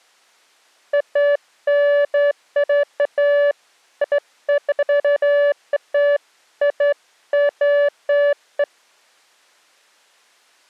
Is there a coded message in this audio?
No, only beeps of irregular length.